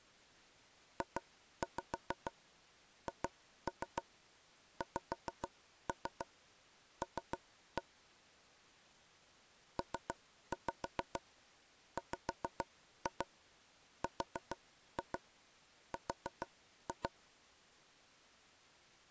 Tap code, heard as taps on a table, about 6 knocks a second. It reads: JHXL PWRR